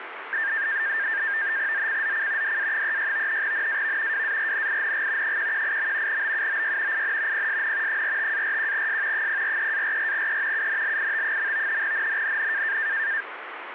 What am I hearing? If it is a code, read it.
NAVTEX (SITOR-B), 100 baud, 170 Hz shift, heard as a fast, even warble, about 1700 Hz centre, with radio static. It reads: ZCZC DA36 NAV WARNING 118. BUOY IN PSN 45-41S 043-44E UNLIT. NNNN